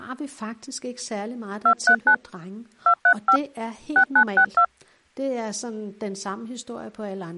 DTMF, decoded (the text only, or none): 239 235 6962